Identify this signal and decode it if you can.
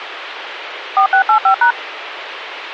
DTMF, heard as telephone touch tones, dialled by machine, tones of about 100 ms, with radio hiss. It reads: 4685#